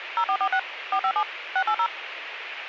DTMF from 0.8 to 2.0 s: 457 680

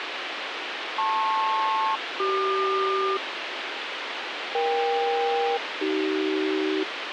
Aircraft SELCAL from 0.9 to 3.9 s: LP-CQ

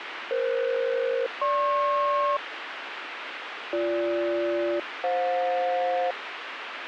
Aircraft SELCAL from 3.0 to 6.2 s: BG-FJ

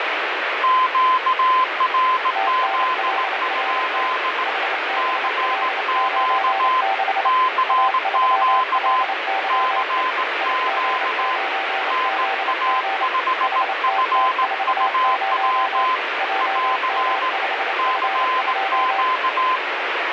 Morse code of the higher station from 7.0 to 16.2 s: CQ CQ NA5FUW

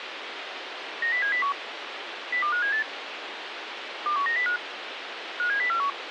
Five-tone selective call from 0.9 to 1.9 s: 90701

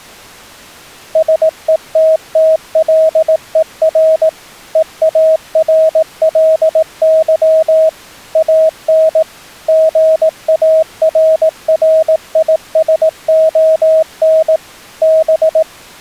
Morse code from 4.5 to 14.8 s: EARLY AN GARRISON

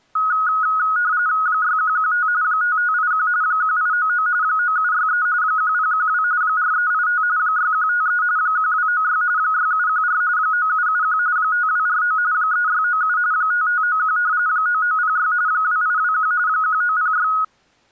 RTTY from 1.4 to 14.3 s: 6115 5581 1899 9763 1012 4385 6153 1296 6714 9771 5249 3697 5591

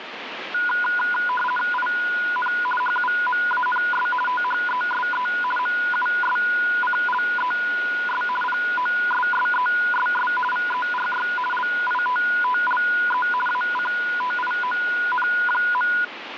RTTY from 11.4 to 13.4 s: LITTLE

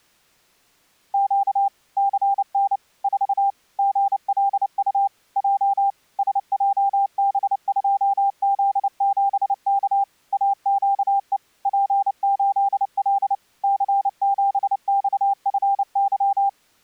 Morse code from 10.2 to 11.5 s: AQE

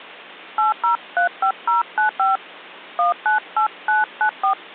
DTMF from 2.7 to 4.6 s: 198994

